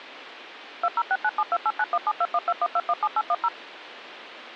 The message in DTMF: 20697289172121217810

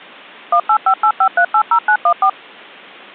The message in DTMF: 18585380914

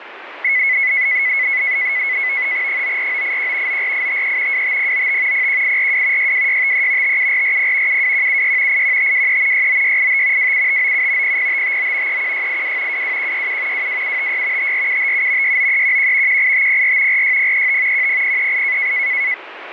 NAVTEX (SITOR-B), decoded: 94981 94853 25095 01842 62653 57440 72176 81523 69685 27597 00559 31682 22167 22756 54757 69311 18504 46035 10038

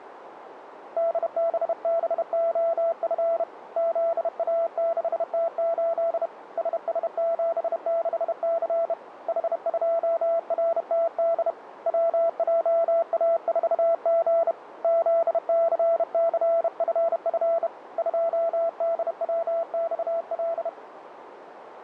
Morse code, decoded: DBBOF ZA6T8 SS76C H2RTD WJA4G ZCCFF 2DWXL

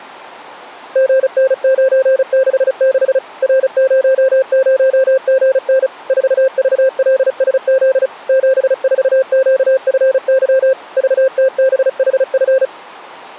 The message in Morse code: GN966 R00GN 4VLSZ 74QFY VTBHF

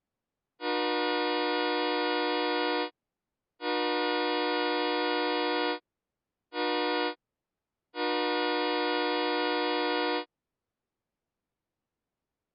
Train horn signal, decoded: 2 long, 1 short, 1 long

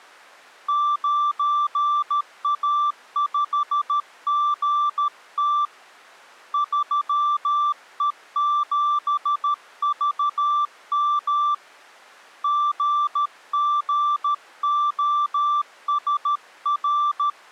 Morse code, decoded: 9A5GT 3E7VM GGOSR

